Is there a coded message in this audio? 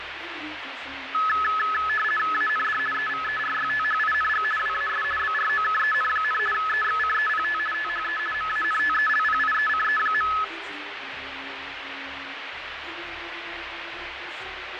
Yes: RTTY (50 baud, 450 Hz shift) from 1.1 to 10.4 s, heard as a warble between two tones, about 1500 Hz centre, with radio static and fading. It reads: AND EVERYTHING WAS BROKEN, EXCEPT THE MANTELPIECE.